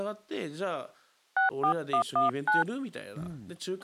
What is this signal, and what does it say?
DTMF, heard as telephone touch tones, dialled by hand, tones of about 120 ms, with speech in Japanese. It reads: 64119